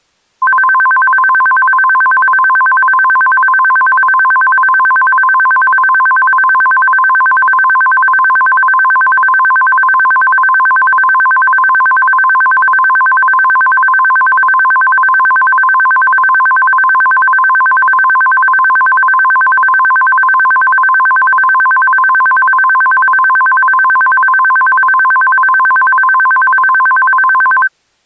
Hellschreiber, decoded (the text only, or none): none